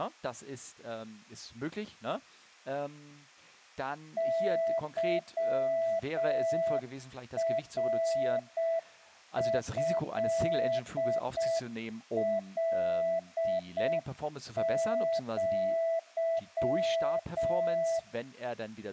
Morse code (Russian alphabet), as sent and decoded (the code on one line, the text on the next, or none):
-.-- .-. ..-.. .-.. --.--
ЫРЭЛЪ